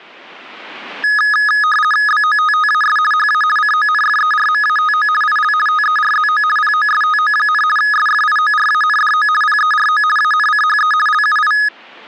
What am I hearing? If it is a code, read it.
RTTY (50 baud, 450 Hz shift), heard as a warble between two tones, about 1470 Hz centre. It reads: BOTTAS HA CONFERMATO IL TERZO POSTO, SFIORANDO PERO ANCHE LUI